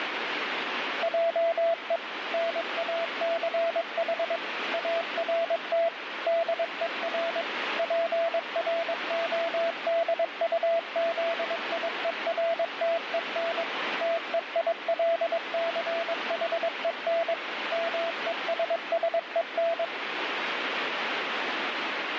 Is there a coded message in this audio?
Yes: Morse code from 1.0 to 19.9 s, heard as a keyed tone, machine-sent, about 22 wpm, 670 Hz, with radio static. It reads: JE NACH ART DER PRODUZIERTEN TEILCHEN MESSEN